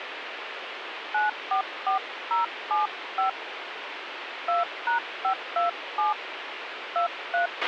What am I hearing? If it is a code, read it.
DTMF, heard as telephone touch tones, dialled by hand, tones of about 120 ms, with radio hiss and a squelch burst at the end. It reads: 944075 2#527 23